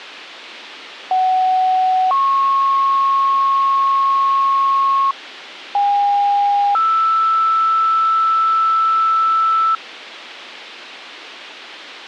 Two-tone page, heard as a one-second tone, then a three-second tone, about 750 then 1090 Hz, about 810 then 1320 Hz.